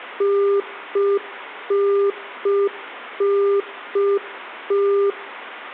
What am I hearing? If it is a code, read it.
Telephone call progress tone (UK plan), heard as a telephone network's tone, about 400 Hz, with room echo. Congestion tone.